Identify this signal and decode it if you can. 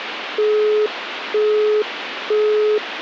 Telephone call progress tone (single-tone plan, as in Europe, Japan and elsewhere), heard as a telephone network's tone, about 420 Hz, 0.48 s on and 0.48 s off, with phone line noise. Busy tone.